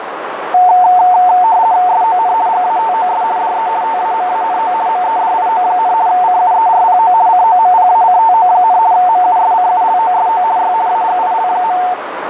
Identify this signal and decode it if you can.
RTTY (50 baud, 170 Hz shift), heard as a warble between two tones, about 810 Hz centre, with radio static and a narrow filter. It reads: SON GATOS DE TAMANO MEDIO, CUERPO COMPACTO, MUSCULOSO Y AGIL.